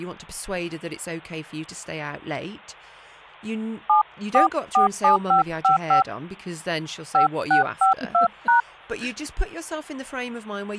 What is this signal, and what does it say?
DTMF, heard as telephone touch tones, dialled by hand, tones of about 120 ms, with speech in English. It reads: 7447555 5652#